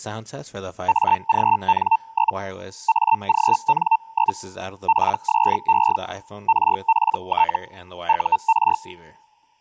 Hellschreiber (Feld-Hell, 122.5 baud), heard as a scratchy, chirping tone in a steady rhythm, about 900 Hz. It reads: AGN? AGN? PSE RPT UR